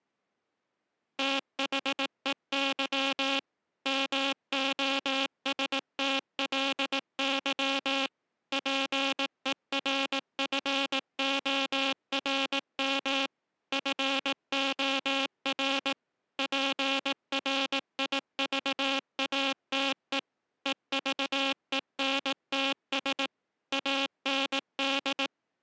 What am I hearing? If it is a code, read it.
Morse code, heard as a buzzer, machine-sent, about 18 wpm. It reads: THEY MOSTLY PERFORM FOR PRIVATE EVENTS AND